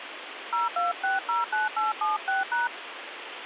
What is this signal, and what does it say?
DTMF, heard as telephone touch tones, dialled by hand, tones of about 160 ms, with phone line noise. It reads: 02609876#